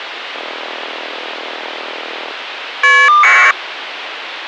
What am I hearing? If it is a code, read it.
Caller ID data burst, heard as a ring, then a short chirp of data, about 1200 baud, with phone line noise.